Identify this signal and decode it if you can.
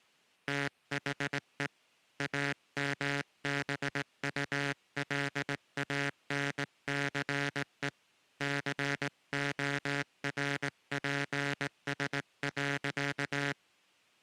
Morse code, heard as a buzzer, hand-sent with a straight key, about 18 wpm. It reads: THE AMBULANCE CORPS.